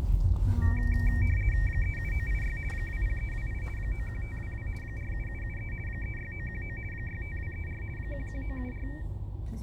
RTTY (50 baud, 450 Hz shift), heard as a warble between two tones, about 2100 Hz centre, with fading and the noise inside a car. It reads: 37986 20328 91522 47773 36919 65234 11974